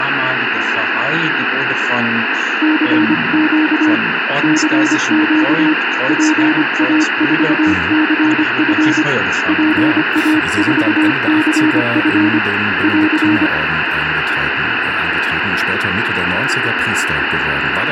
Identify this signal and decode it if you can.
Morse code, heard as a keyed tone, hand-sent with a paddle, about 25 wpm, 310 Hz, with radio static. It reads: CQ CQ PA4CF PA4CF <AR>